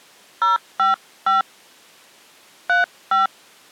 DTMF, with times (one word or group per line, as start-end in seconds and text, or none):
0.4-1.4 055
2.7-3.3 35